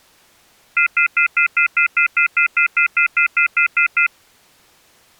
Telephone call progress tone (North American plan), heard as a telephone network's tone, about 1400, 2050, 2450, 2600 Hz, 0.1 s on and 0.1 s off. Off-hook warning tone.